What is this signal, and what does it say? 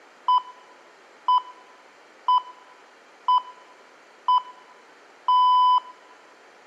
Radio time signal (six pips, as the Greenwich Time Signal), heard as pips, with room echo.